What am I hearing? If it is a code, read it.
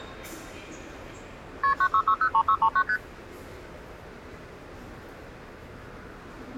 Multi-frequency trunk signalling (R1, as on North American trunks), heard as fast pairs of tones, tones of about 70 ms, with the noise of a subway station. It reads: KP 96603639 ST